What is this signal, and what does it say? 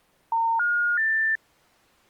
Telephone call progress tone (North American plan), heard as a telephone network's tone, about 910, 1430, 1800 Hz. Special information tone.